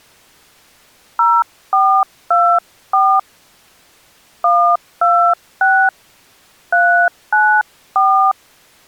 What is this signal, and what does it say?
DTMF, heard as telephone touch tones, dialled by hand, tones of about 290 ms. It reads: 0424 126 394